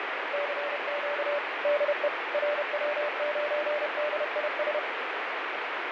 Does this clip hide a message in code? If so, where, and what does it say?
Yes: Morse code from 0.3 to 4.8 s, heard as a keyed tone, machine-sent, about 31 wpm, 590 Hz, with heavy radio static and fading. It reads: CQ DE RW9DIS